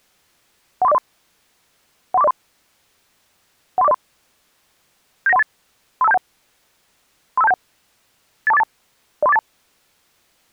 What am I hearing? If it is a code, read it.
Five-tone selective call (EIA), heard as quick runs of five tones, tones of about 30 ms. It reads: 13403 13403 13403 79138 35271 35271 82482 03482